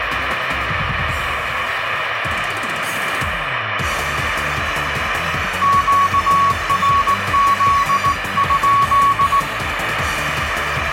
Morse code, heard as a keyed tone, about 18 wpm, 1120 Hz, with radio static and room echo. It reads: QRZ?